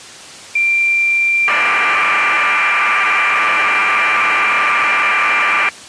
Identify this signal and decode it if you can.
Cassette data (Kansas City type), 1200 baud, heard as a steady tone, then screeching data.